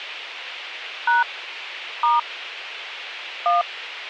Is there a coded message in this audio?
Yes: DTMF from 1.1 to 3.6 s, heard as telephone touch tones, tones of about 160 ms, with a squelch burst at the end. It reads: # * 1